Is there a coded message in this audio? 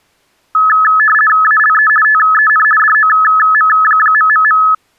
Yes: RTTY (50 baud, 450 Hz shift) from 0.5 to 4.7 s, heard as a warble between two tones, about 1500 Hz centre. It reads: ALE TEN DOM...